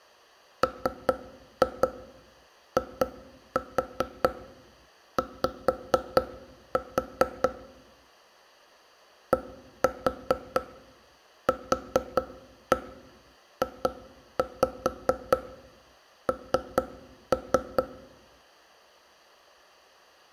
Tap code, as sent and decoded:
3-2 2-4 5-4 / 1-4 4-1 2-5 3-3
MIY DQJN

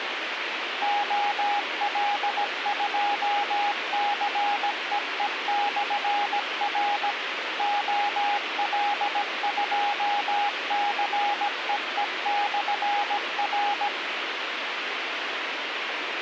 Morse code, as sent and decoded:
--- .-.. ..--- -.-. . . -..-. .-. / --- .-.. ..--- -.-. . . -..-. .-.
OL2CEE/R OL2CEE/R

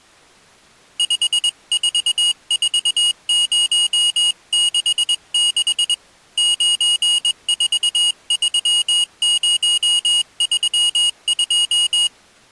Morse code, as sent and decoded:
..... ....- ....- ----- -.... -.... / ----. ....- ...-- ----- ...-- ..---
544066 943032

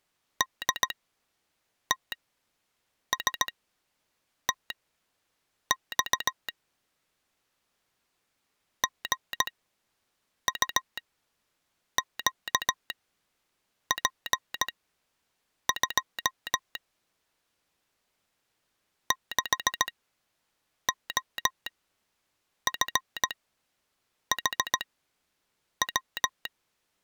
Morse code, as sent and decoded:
-.. - ... - -..- / --. ..- --.- .--. ..--- / -.... --- ..-. .... .--
DTSTX GUQP2 6OFHW

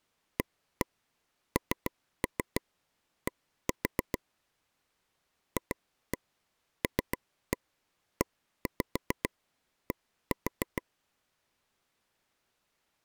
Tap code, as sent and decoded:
1-1 3-3 1-4 / 2-1 3-1 1-5 1-4
AND FLED

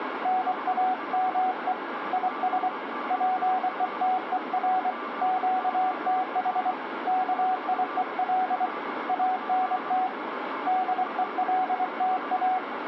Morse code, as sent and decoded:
-. .- -- . / .. ... / .--. . - . .-. / --.- - .... / -.- .. . .-.. / .- -. - / -.. . .-.. - .-
NAME IS PETER QTH KIEL ANT DELTA

